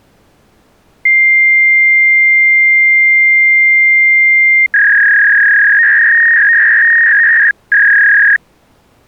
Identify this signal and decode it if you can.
Fax machine handshake, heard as a long tone and a warble.